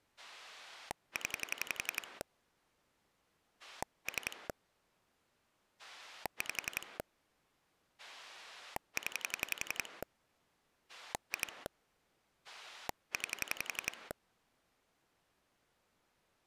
Pulse dialling, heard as a rotary dial, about 11 pulses a second. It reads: 0 3 5 0 2 9